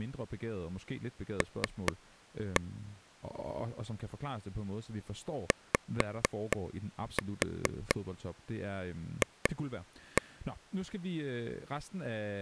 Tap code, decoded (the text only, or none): L YF